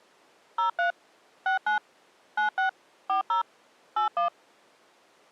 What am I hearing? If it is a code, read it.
DTMF, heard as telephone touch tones, dialled by machine, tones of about 120 ms. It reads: 03 69 96 40 81